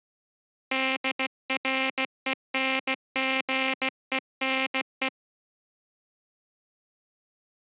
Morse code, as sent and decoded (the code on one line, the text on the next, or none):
-.. .-. . -. --. . -. .
DRENGENE